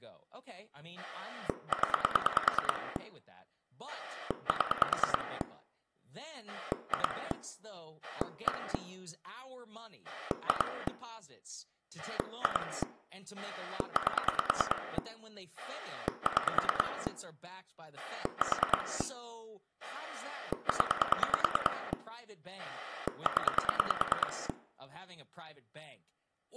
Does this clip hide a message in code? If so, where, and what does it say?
Yes: pulse dialling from 1.0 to 24.5 s, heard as a rotary dial, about 9 pulses a second, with room echo and speech in English. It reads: 0 7 2 1 2 2 8 6 4 0 0